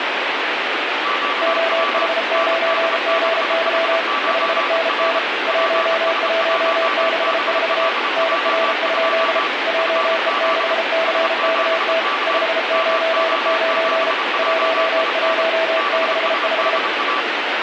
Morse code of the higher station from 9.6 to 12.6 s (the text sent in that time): FZ S7K